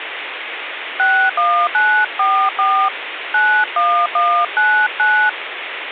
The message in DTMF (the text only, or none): 61944 91199